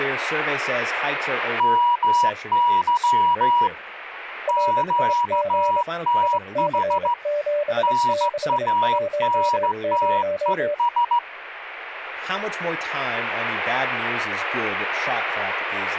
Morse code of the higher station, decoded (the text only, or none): MY QTH NANTES